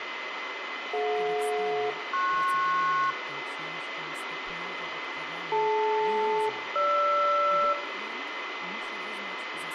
Aircraft SELCAL, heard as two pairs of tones, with radio static, room echo and speech in English. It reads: DJ-PS DL-GR